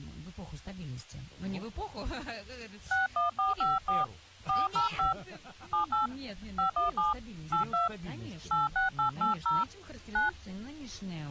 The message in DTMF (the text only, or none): 61454 405 78 517 82 86880 9